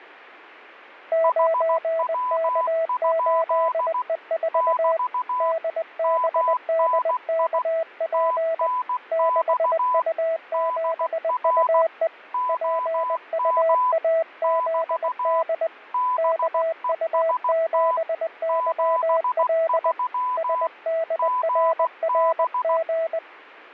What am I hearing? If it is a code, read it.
Morse code, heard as two keyed tones. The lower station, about 20 wpm, 650 Hz: 9K8E4 DBDKP 6U7UE PUAZD KU7YL SDRRG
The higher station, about 16 wpm, 1000 Hz: HW? <BT> MNI TNX DR OM <BT> BEST 73 GB